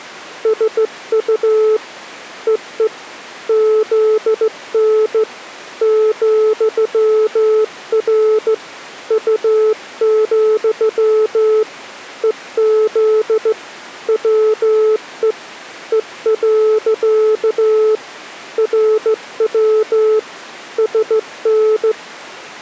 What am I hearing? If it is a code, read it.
Morse code, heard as a keyed tone, hand-sent with a straight key, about 15 wpm, 430 Hz. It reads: SU EE ZN ,R U, EZ WE E. RW SN